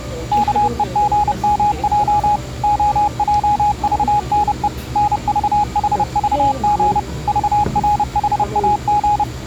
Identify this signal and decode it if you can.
Morse code (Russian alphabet), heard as a keyed tone, machine-sent, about 30 wpm, 830 Hz, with the noise of a cafe. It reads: КЕГМЙ ОЙЖНЕ НЖХЖГ ЖРХАГ